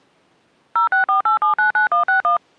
DTMF, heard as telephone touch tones, dialled by machine, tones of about 120 ms. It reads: 0648799161